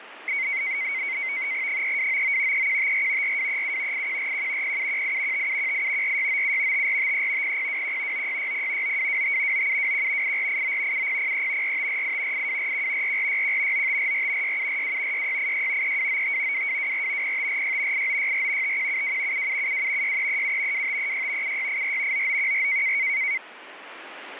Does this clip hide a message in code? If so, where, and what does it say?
Yes: NAVTEX (SITOR-B), 100 baud, 170 Hz shift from 0.3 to 23.4 s, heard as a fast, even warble, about 2150 Hz centre, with radio static. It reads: 3299 3154 4237 8141 0718 5718 4697 5453 0021 9660 9225 9721 8489 7003 4548 8241 4461 9544 6742 6686 3295 2224 0546 8964 5172 7772 6337 2536 7684 9914